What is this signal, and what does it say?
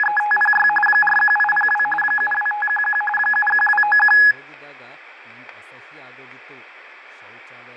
RTTY (45.45 baud, 850 Hz shift), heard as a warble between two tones, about 1260 Hz centre, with radio static, fading and speech in Kannada. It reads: … 41802 72511 71291